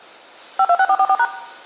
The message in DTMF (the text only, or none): 526444#